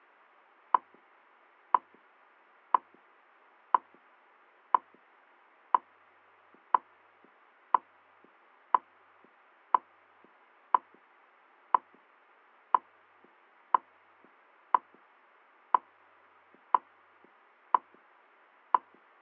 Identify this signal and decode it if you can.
Radio time signal (WWV, Colorado), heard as ticks, one a second.